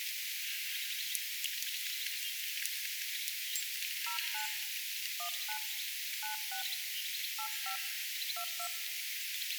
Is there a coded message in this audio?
Yes: DTMF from 4.1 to 8.7 s, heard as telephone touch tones, dialled by hand, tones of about 100 ms, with room echo. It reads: 09 19 96 85 22